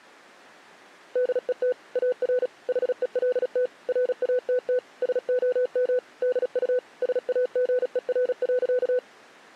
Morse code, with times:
1.2-1.7 DET
2.0-2.5 AR
2.7-3.7 HELT
3.9-4.8 RATT
5.0-6.0 SOM
6.2-6.8 DU
7.0-9.0 SAGER.

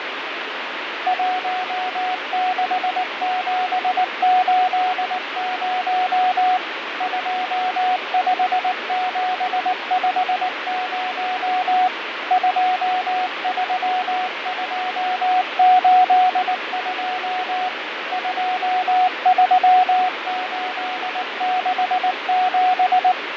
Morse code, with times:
1.1-6.6 16780
7.0-11.9 25750
12.3-17.7 23282
18.1-23.1 23867

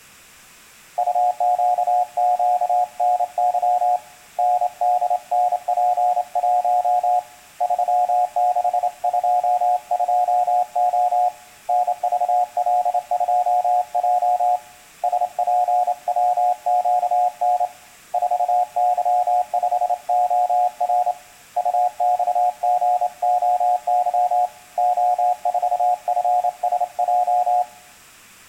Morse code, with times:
1.0-4.0 UQQNY
4.4-7.2 NDNP1
7.6-11.3 3622O
11.7-14.6 NVL2J
15.0-17.7 SPWQN
18.1-21.1 4Y5OR
21.6-24.5 UXGOY
24.8-27.6 O4FSJ

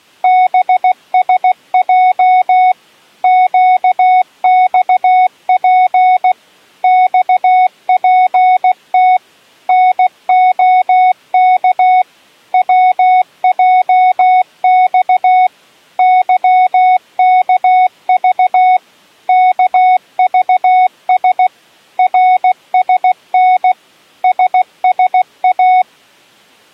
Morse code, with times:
0.2-2.7 BSJ
3.2-6.3 QXP
6.8-9.2 XPT
9.7-12.0 NOK
12.5-15.5 WJX
16.0-18.8 YKV
19.3-21.5 KVS
22.0-23.7 RSN
24.2-25.8 SSA

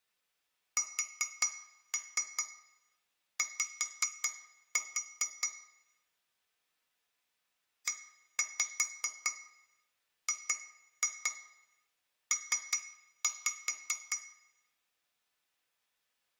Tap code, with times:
0.8-5.5 SY
7.9-14.2 EGP

